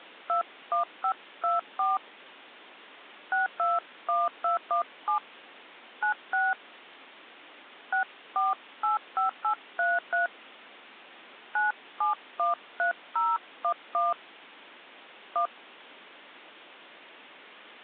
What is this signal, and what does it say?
DTMF, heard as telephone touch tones, dialled by hand, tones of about 140 ms. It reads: 21524 621217 96 6485833 9713011 1